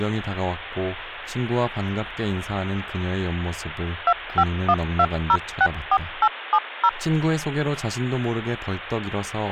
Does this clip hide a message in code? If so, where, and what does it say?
Yes: DTMF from 4.1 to 6.9 s, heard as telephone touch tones, dialled by machine, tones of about 60 ms, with speech in Korean. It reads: 2512064870